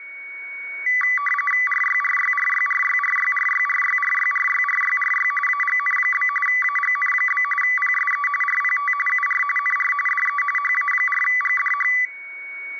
RTTY (45.45 baud, 850 Hz shift), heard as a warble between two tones, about 1550 Hz centre, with a steady whistle near 2230 Hz. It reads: RYRYRYRYRYRYRYRYRYRYRY AGN? AGN? PSE RPT UR NR DE HA4GDH